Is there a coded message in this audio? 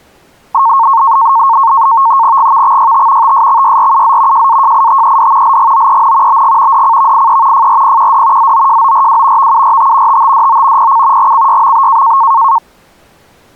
Yes: NAVTEX (SITOR-B), 100 baud, 170 Hz shift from 0.5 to 12.6 s, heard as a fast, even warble, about 1000 Hz centre. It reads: GVXYT TSXYRUZ JAJITED LGOEN BG DCVIE FRPQD ZOJORW VURT TTDO PC GCYMB